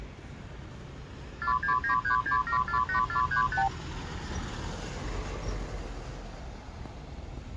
Multi-frequency trunk signalling (R2, with the far end's replies), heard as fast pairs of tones, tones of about 100 ms, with street noise. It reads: 46936748435